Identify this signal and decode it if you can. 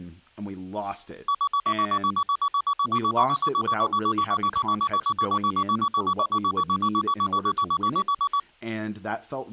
Evenly repeated beeps, with speech in English. There is no code.